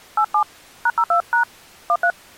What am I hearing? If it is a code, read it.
DTMF, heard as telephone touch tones, dialled by hand, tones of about 80 ms. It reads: 87 #02# 13